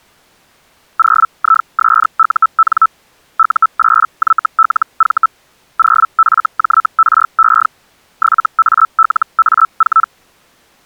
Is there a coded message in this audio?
Yes: Hellschreiber (Feld-Hell, 122.5 baud) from 1.0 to 10.1 s, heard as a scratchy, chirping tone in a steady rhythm, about 1320 Hz. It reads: 0ISUN U8YLV 0FJRE 7ALA4